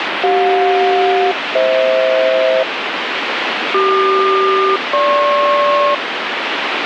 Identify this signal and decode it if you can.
Aircraft SELCAL, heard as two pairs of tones, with radio static. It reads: CJ-FH CQ-GP